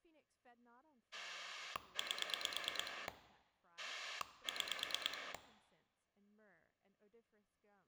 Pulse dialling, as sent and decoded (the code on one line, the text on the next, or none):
8 / 6
8 6